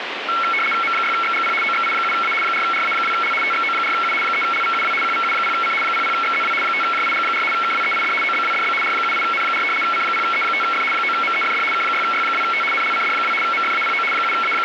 RTTY (75 baud, 850 Hz shift), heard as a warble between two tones, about 1800 Hz centre, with radio static. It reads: M6XGP OXI7A 4RA2L TXO4U 3LVUW QVU0C 00XZW 5JIG4 KWEID OBWDB R78N4 C0E5F 9MEFD K6Y2T NLCD2 MFAPO …